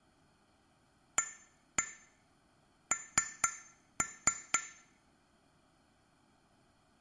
Tap code, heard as taps on glass, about 4 knocks a second, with room echo. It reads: AN